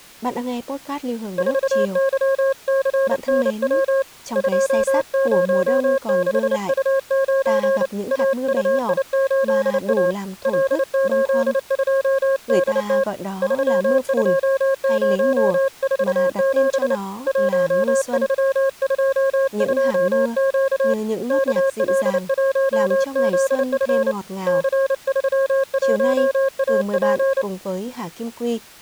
Morse code, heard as a keyed tone, hand-sent with a paddle, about 29 wpm, 540 Hz, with speech in Vietnamese. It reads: 4YCNW 206U9 AUI8A L82DT 32047 1322Q KL1ZF C31AP